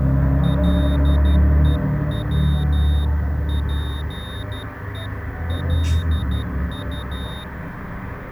Morse code (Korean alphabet), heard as a high beeper, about 12 wpm, 3700 Hz, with street noise. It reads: 갑자기